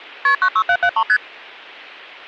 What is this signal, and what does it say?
Multi-frequency trunk signalling (R1, as on North American trunks), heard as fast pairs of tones, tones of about 70 ms. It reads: KP 96773 ST